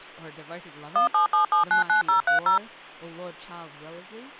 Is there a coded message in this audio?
Yes: DTMF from 1.0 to 2.6 s, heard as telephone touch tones, dialled by machine, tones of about 120 ms, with hum and speech in English. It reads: 177799030